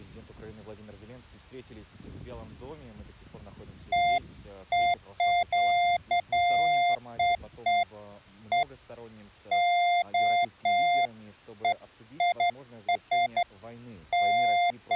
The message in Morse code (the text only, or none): none